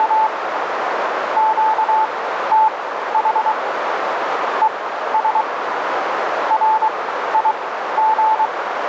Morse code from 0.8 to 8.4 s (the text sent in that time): QTH ES RIG